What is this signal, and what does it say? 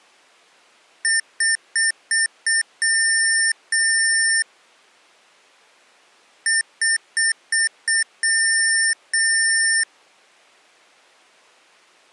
Beep code, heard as beeps from a small speaker, played twice, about 1800 Hz. 5 short, 2 long.